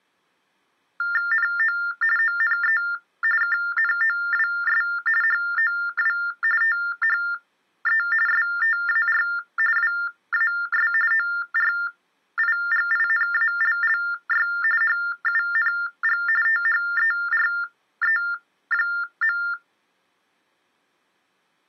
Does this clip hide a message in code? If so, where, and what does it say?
Yes: TTY/TDD text telephone tones (45.45 baud Baudot) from 1.0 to 19.5 s, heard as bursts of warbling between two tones, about 400 Hz shift, 1600 Hz centre. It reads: NO ONE KNOWS HOW THE STAR WAS ORIGINALLY HUNG THERE.